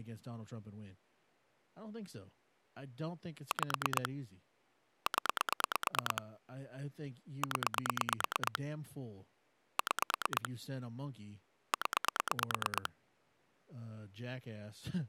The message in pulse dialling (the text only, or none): 5 0 0 6 0